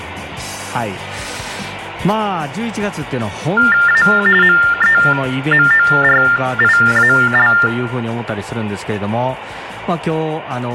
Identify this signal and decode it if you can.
TTY/TDD text telephone tones (45.45 baud Baudot), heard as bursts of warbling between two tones, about 400 Hz shift, 1600 Hz centre. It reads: A MEMORIAL